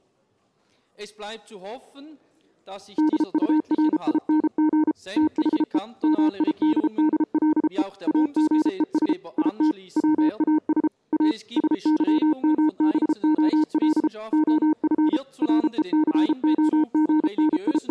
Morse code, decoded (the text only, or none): DURING THE MIDDLE AGES IT WAS A SYMBOL OF …